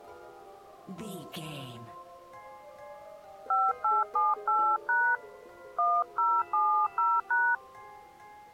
DTMF, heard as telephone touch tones, dialled by hand, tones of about 260 ms. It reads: 5878# 1070#